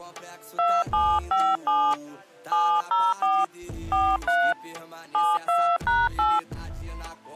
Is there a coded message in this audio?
Yes: DTMF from 0.6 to 6.4 s, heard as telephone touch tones, dialled by hand, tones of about 250 ms. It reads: 2757 704 43 72#8